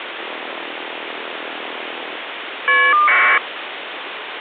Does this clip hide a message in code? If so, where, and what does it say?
Yes: caller ID data burst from 0.2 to 3.4 s, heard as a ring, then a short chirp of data, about 1200 baud, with phone line noise.